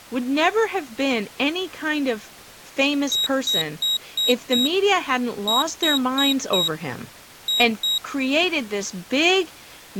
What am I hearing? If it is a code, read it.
Beep code, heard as a piezo beeper, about 3800 Hz, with speech in English. 5-4-2.